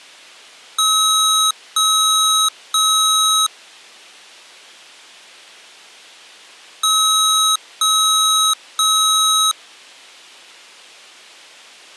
Beep code, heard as beeps from a small speaker, played twice, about 1280 Hz. 3 long. In IBM BIOS tables: keyboard card error.